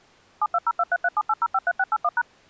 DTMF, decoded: 72023378053681#

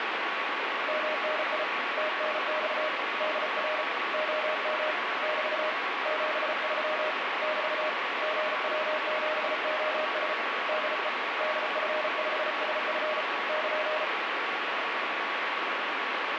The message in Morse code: MNI TNX DR OM <BT> 73 <BT> GW7OS DE DF5SF <KN>

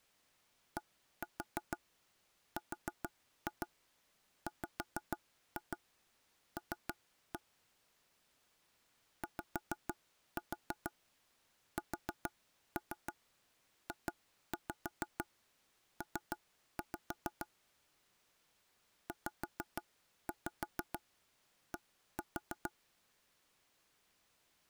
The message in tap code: DRWL YSJP ZD

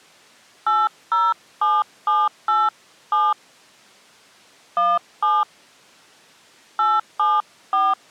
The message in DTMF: 807787 17 874

